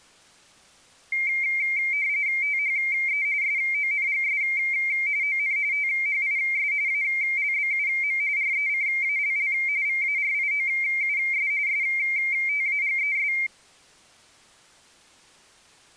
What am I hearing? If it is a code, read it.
RTTY (45.45 baud, 170 Hz shift), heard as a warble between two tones, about 2200 Hz centre. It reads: THE SONGS ON THIS ALBUM RECALL VARIOUS STAGES